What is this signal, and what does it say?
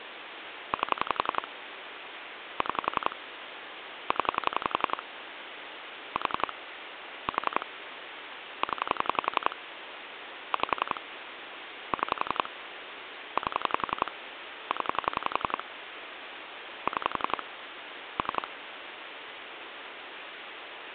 Pulse dialling, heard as clicks on a phone line, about 11 pulses a second, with phone line noise. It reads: 8 6 0 4 4 0 5 6 8 0 6 3